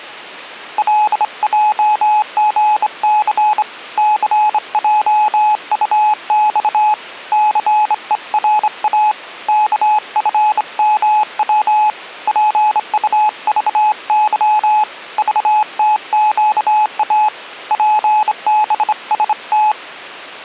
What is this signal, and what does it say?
Morse code, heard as a keyed tone, hand-sent with a straight key, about 26 wpm, 850 Hz. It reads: LJGC CJUX CERA KFMW PUVY VTQA PBST